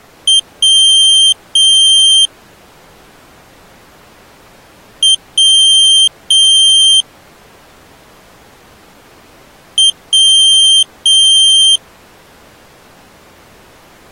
Beep code, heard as a piezo beeper, played three times, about 3150 Hz. 1 short, 2 long.